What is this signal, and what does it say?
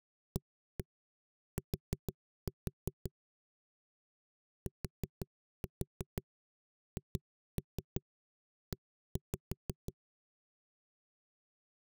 Tap code, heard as knocks on a wall, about 6 knocks a second. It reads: AT THE